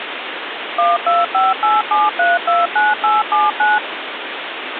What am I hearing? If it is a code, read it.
DTMF, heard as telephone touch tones, dialled by machine, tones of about 190 ms, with phone line noise. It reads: 12587329879